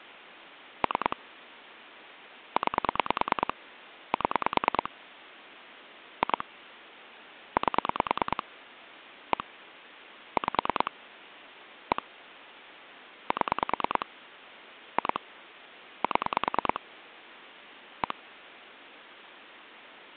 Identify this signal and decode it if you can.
Pulse dialling, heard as clicks on a phone line, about 9 pulses a second. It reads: 3 9 7 2 8 1 5 1 7 2 7 1